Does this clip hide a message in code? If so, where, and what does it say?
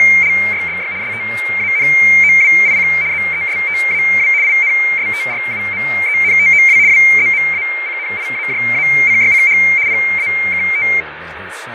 Yes: RTTY (75 baud, 170 Hz shift) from 0.0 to 11.0 s, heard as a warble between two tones, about 2200 Hz centre, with radio static, fading and speech in English. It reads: … STANOWIC ZESTAW INSTRUMENTOW WZMACNIAJACYCH PAKT